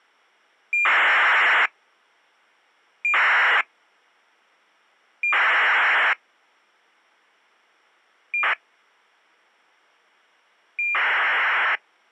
ACARS aircraft data, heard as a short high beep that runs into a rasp, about 2400 baud.